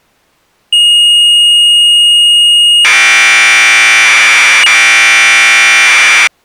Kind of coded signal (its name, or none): Commodore tape loading